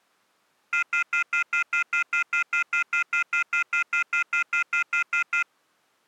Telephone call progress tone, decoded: off-hook warning tone

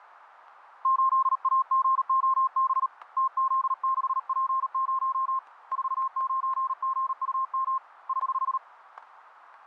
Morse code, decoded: 8AGOB TZ6P0 49GUM <HH>

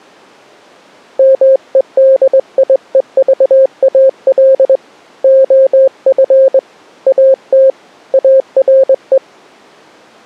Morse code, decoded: MEDIEVAL OF AT ARE

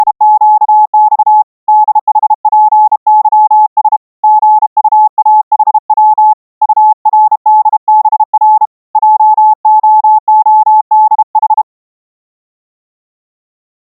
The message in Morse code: … DHPYS GUAHW URDBR JOODH

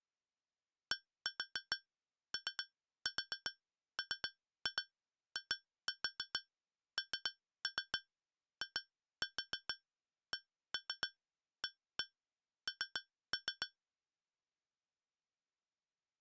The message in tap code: DOMINICAN

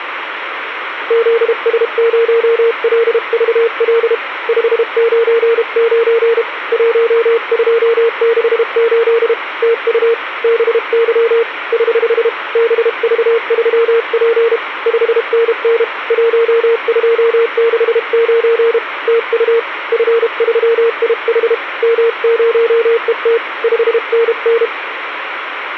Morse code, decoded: ZS0LVL 599 1268 TU BY <HH> BV3P 5NN 1269 TU F3IH M0ET 5NN

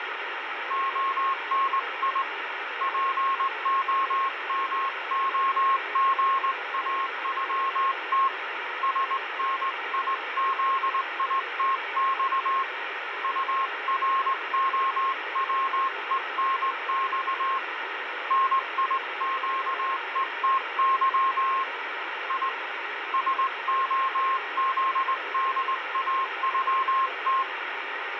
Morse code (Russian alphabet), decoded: ОНИ ПОМОГАЮТ СНИЗИТЬ УРОВЕНЬ НИЩЕТЫ И СОЗДАЮТ

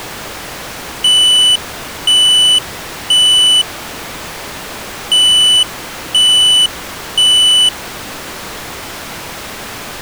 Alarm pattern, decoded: temporal three

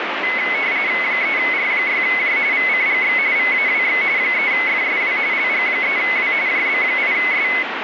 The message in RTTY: 3R6J VCGX VAWX 3FSW LG3W JB8S

